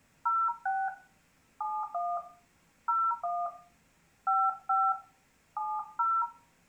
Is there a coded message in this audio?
Yes: DTMF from 0.3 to 6.2 s, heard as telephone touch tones, dialled by hand, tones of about 230 ms. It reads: 06 71 01 55 70